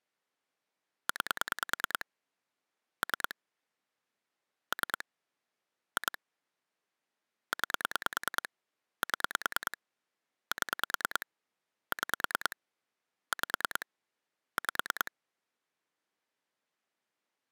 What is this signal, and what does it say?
Pulse dialling, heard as clicks on a phone line, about 9 pulses a second. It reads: 9 3 3 2 9 7 7 6 5 5